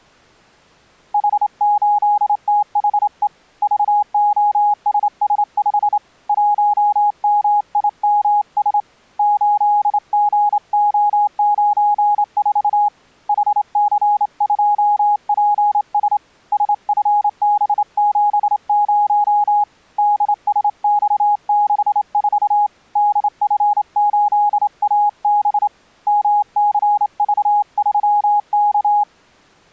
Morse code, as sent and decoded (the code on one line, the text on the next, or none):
.... ---.. - .... . / ...- --- ... ... ..... / .---- -- .. -- ... / ---.. --. --- ----. ....- / .... -.-. ..--- .--. ... / ... ..-. -... --... ----- / -.. ... -..- -.... ....- / -.. ..-. ---.. .- -... / -- -.-. ...- ...-- -.-
H8THE VOSS5 1MIMS 8GO94 HC2PS SFB70 DSX64 DF8AB MCV3K